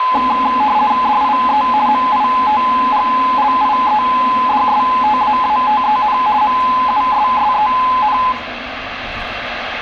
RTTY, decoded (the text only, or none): DIE MITGLIEDSTAATEN MUSSEN